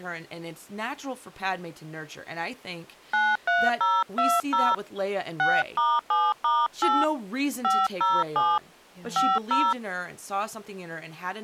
DTMF, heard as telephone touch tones, dialled by hand, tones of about 220 ms, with speech in English. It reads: 93020 6*7*8 507 50